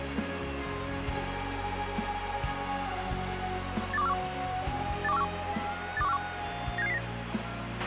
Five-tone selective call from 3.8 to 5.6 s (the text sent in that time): 82141 82141